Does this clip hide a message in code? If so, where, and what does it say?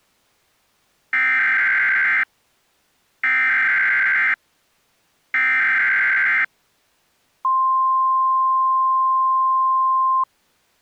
Yes: Emergency Alert System (SAME) tones (header bursts, then the 1050 Hz attention tone) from 1.1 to 10.2 s, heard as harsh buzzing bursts, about 520.83 baud.